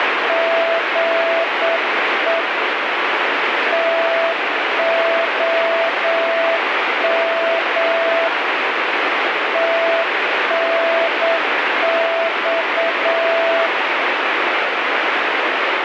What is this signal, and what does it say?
Morse code, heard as a keyed tone, hand-sent with a straight key, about 8 wpm, 660 Hz, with heavy radio static. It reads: GE TOM TNX